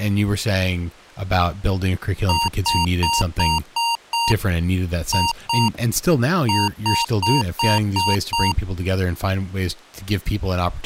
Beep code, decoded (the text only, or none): 6-2-6